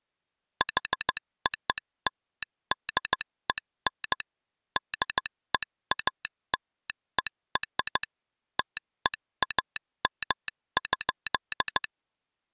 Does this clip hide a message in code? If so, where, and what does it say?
Yes: Morse code (American railroad code) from 0.5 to 11.9 s, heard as a telegraph sounder, machine-sent. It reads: HOLDEN DEALER TEAM.